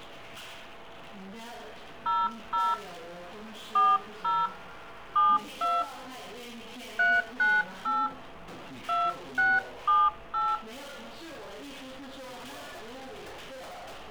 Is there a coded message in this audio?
Yes: DTMF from 2.1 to 10.5 s, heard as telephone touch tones, dialled by hand, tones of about 210 ms. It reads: 00 40 72 398 2678